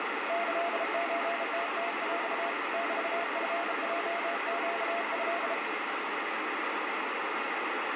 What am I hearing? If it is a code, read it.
Morse code (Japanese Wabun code), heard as a keyed tone, hand-sent with a bug key, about 33 wpm, 690 Hz, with heavy radio static. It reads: キソムムヰ メチヲネト